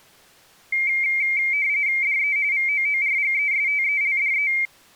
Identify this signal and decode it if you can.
RTTY (45.45 baud, 170 Hz shift), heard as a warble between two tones, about 2200 Hz centre. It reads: DE VOORGESTELDE